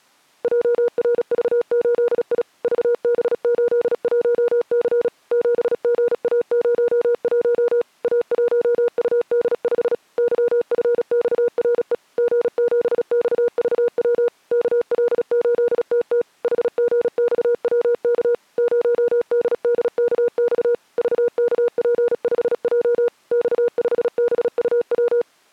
Morse code, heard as a keyed tone, machine-sent, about 36 wpm, 480 Hz. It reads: JRV8I VB81C 7GA01 A1UD5 YFXRE G7XVW KL8TT HGXWK 0DDKX VKP5J X5BUW